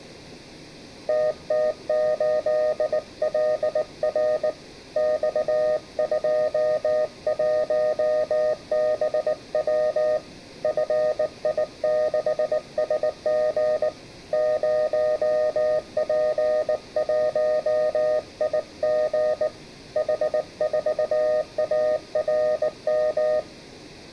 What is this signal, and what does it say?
Morse code, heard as a keyed tone, hand-sent with a bug key, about 19 wpm, 620 Hz, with room echo. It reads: TT8LR X21BW FI6SG 0P1IG H4ARM